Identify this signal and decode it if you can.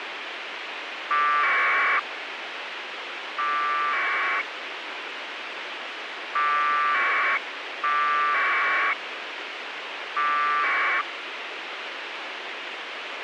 Packet radio (AX.25, as in APRS), 1200 baud, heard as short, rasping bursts, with radio hiss.